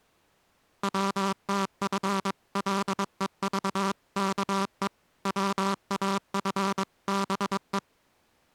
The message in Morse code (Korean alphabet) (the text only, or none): 번갈아 본다